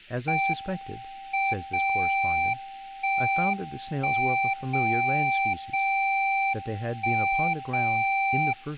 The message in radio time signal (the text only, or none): M 0 1 1 0 0 1 0